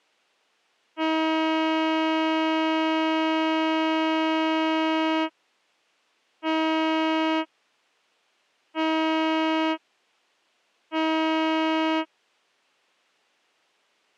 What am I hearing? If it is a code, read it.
Ship horn signal, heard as a ship's horn, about 320 Hz. 1 long, 3 short. At sea: a vessel under tow in fog.